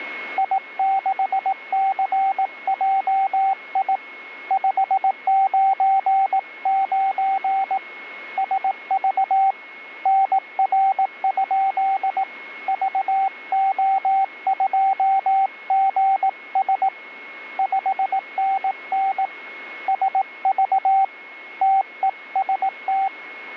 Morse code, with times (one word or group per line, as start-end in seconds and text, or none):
0.4-4.0 I6CJI
4.5-7.8 599
8.4-9.5 SV
10.1-12.2 NR?
12.7-16.9 VO2GS
17.6-19.3 5NN
19.9-21.0 SV
21.6-23.1 TEST